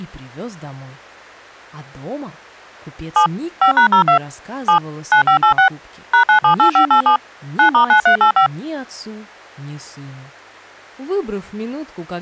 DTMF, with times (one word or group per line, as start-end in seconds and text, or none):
3.2-3.3 7
3.6-4.2 5#02
4.7-4.8 7
5.1-5.7 9586
6.1-7.2 #978587
7.6-8.5 9*9385